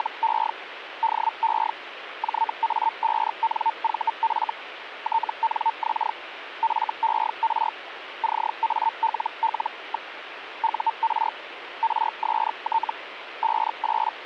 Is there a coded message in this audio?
Yes: Hellschreiber (Feld-Hell, 122.5 baud) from 0.0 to 14.3 s, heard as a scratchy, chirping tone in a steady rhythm, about 900 Hz, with radio static. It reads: … DE JA5NVF TNX FER CALL. UR RST …